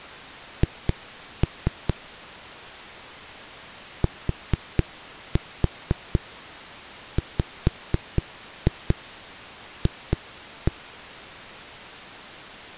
Tap code, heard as knocks on a wall, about 4 knocks a second. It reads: H TWF